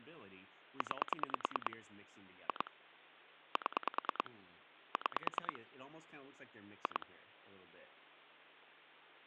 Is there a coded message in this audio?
Yes: pulse dialling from 0.8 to 7.0 s, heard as clicks on a phone line, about 9 pulses a second, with hum and speech in English. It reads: 9 2 7 6 2